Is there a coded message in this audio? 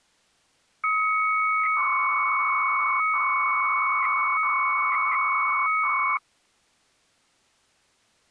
Yes: 300-baud modem data (Bell 103 tones) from 0.8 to 6.2 s, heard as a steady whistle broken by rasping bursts, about 300 baud, 200 Hz shift.